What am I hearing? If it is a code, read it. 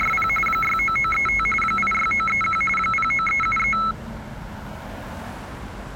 RTTY (45.45 baud, 850 Hz shift), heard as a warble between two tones, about 1750 Hz centre, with street noise. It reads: … 69935 86931 09373